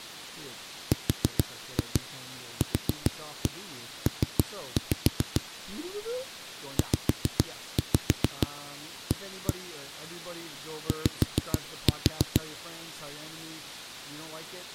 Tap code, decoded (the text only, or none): RQP ZA Y